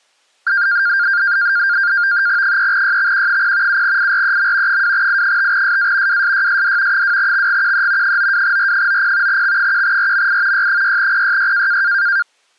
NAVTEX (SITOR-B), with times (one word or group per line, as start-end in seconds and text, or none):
2.4-3.8 3YXQ0
3.7-4.8 7IREM
4.7-6.2 2I5SA
6.1-7.0 WSYSD
6.9-8.2 2XGQE
8.0-9.4 92R90
9.3-10.7 X1RMI
10.5-11.8 Y6PYY